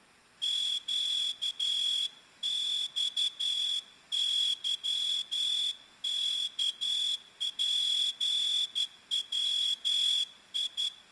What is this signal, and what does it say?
Morse code (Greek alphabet), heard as a whistle, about 12 wpm, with room echo. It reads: ΨΞΥΚΠΩΙ